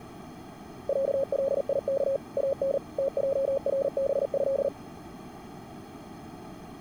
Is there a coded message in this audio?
Yes: Morse code (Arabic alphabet) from 0.8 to 4.7 s, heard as a keyed tone, machine-sent, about 39 wpm, 540 Hz. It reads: عليك ان تجربه